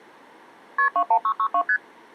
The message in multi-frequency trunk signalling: KP 21662 ST

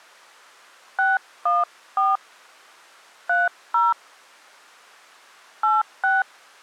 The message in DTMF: 614 30 86

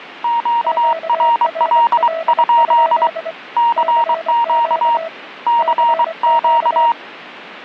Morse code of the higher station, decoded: QRL? CQ CQ

